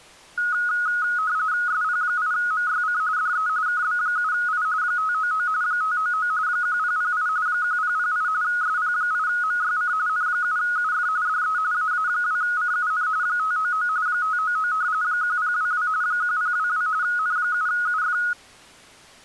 RTTY (45.45 baud, 170 Hz shift), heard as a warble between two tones, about 1360 Hz centre. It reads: SP8MYC DE KB7I 599 599 1008 1008 SP8MYC N7UF DE AA2CUN 599 599 1022 1022 N7UF